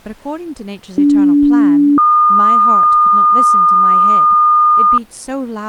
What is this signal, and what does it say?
Two-tone page, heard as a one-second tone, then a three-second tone, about 290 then 1220 Hz, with speech in English.